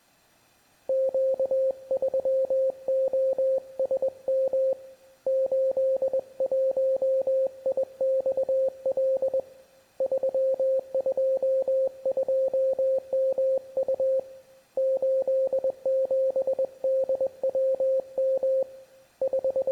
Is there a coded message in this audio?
Yes: Morse code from 0.8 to 19.7 s, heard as a keyed tone, hand-sent with a paddle, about 21 wpm, 530 Hz. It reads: Q3OSM 81IXL 322MU 87DWM …